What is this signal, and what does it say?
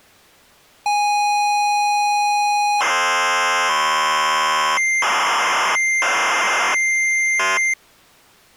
ZX Spectrum tape loading, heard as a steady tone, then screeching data.